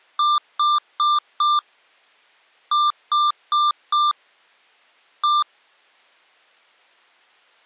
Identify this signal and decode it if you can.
Beep code, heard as beeps from a small speaker, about 1190 Hz. 4-4-1. In Phoenix BIOS tables: serial port failure.